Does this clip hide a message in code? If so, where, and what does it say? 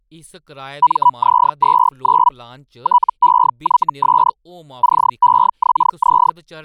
Yes: Hellschreiber (Feld-Hell, 122.5 baud) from 0.8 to 6.3 s, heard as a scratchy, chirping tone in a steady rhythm, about 980 Hz, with speech in Dogri. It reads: MZ29 TEYS CEXZ